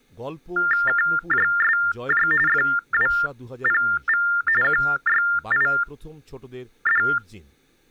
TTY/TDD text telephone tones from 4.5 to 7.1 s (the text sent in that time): QYID